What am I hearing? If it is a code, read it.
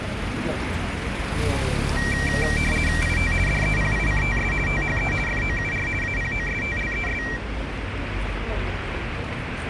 RTTY (50 baud, 450 Hz shift), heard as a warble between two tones, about 2100 Hz centre, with radio static and street noise. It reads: IT DEPICTS THE FOUR APOSTLES